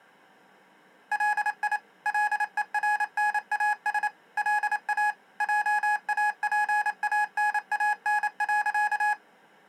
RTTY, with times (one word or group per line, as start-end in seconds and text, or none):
none